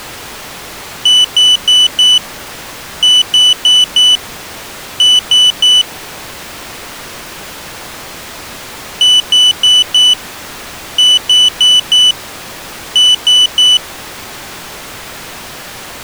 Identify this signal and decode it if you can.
Beep code, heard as a piezo beeper, played twice, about 3000 Hz. 4-4-3. In Phoenix BIOS tables: maths coprocessor failure.